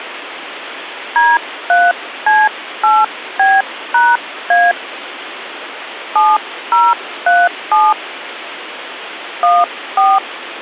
DTMF, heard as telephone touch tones, dialled by hand, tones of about 210 ms, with phone line noise. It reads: D3C8B#A 7037 14